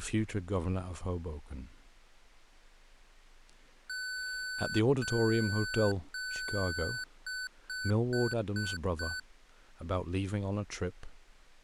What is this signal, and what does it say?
Beep code, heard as beeps from a small speaker, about 1500 Hz, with speech in English. 3 long, 5 short.